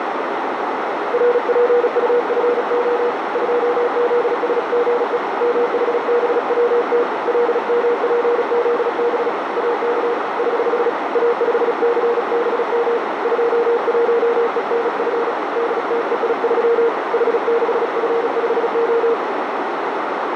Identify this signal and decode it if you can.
Morse code, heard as a keyed tone, hand-sent with a paddle, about 36 wpm, 470 Hz, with heavy radio static and a narrow filter. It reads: RPUFO 2ZSGE MHBWT LMPZB AK <HH> A5CBM 21ENF DTEI3 H6F5O